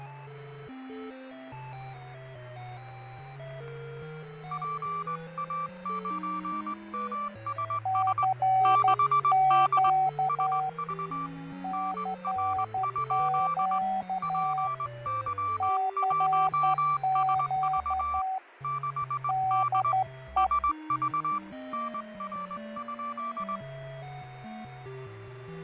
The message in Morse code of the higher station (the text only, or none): PA9MSS 6D SV NR? PY1SV 6D SV NR?